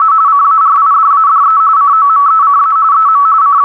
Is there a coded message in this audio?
Yes: RTTY (45.45 baud, 170 Hz shift) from 0.0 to 3.6 s, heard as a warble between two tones, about 1220 Hz centre, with static crashes. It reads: … CARIDADE COMECA EM …